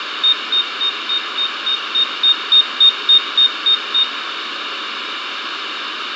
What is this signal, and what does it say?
Evenly repeated beeps, with radio static, fading and room echo. There is no code.